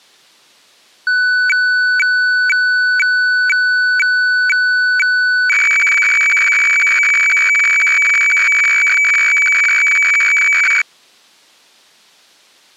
Weather fax (radiofax), 120 lines a minute, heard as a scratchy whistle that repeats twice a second.